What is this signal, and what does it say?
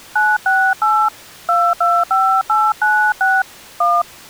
DTMF, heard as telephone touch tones, dialled by hand, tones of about 260 ms. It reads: 968 225896 1